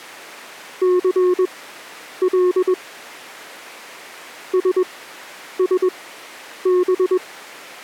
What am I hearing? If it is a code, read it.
Morse code, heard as a keyed tone, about 21 wpm, spaced as for 9 wpm, 360 Hz. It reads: CL SSB